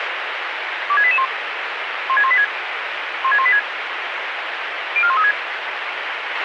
Five-tone selective call (ZVEI), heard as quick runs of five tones, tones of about 70 ms, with radio hiss and a squelch burst at the end. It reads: 26881 16186 16186 04136